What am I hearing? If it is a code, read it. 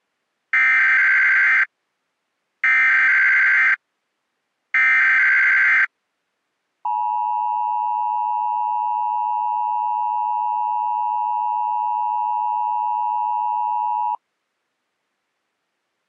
Emergency Alert System (SAME) tones (header bursts, then the 853 and 960 Hz attention tone), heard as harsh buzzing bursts, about 520.83 baud.